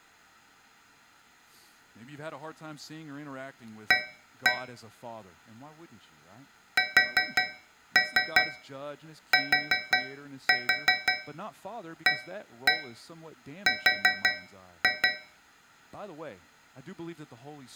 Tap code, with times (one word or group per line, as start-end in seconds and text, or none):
3.9-4.5 A
6.8-15.1 STAR